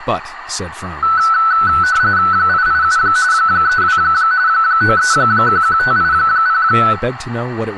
RTTY (45.45 baud, 170 Hz shift), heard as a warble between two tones, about 1410 Hz centre, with radio static, room echo and speech in English. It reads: 887 32 9311580